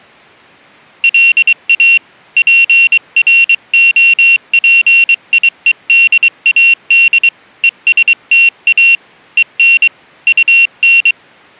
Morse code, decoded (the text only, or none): LA PROPIEDAD ESTA EN UN